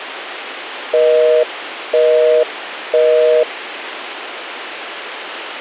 Telephone call progress tone (North American plan), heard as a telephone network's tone, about 480, 620 Hz, 0.5 s on and 0.5 s off, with phone line noise. Busy tone.